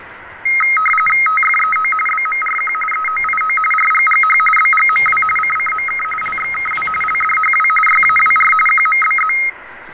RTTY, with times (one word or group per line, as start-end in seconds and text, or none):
1.3-1.9 TFEO
2.1-2.7 BMRQ
2.9-3.6 EOIO
3.7-4.4 RGGH
4.6-5.2 BGMW
5.4-6.0 CCMK
6.2-6.9 LXKW
7.0-7.7 LDHW
7.9-8.5 YAWR
8.7-9.3 QMBZ